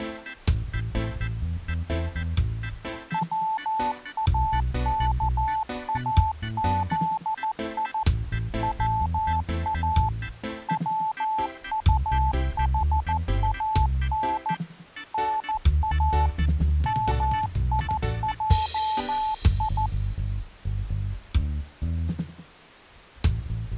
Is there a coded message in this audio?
Yes: Morse code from 3.1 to 19.9 s, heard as a keyed tone, machine-sent, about 14 wpm, 870 Hz. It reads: WAKAZI WA WUHAN NA MIJI